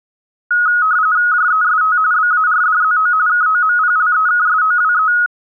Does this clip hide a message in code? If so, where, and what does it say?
Yes: RTTY (45.45 baud, 170 Hz shift) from 0.5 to 5.3 s, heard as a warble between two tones, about 1360 Hz centre. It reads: JEST BARDZO KOMPLEKSOWE